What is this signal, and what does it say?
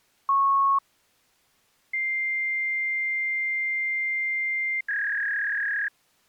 Fax machine handshake, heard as a beep, a long tone and a warble.